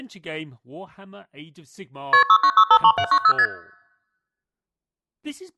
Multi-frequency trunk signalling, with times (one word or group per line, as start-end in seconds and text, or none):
2.1-2.2 KP
2.3-3.3 69653790
3.4-3.5 ST